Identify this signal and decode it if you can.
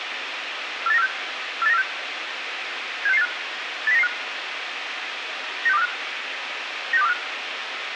Five-tone selective call (EEA), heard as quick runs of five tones, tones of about 40 ms, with radio hiss and room echo. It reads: 48946 48946 76685 80995 96245 96245